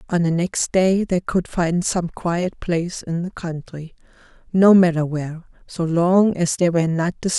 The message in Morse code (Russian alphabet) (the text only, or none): none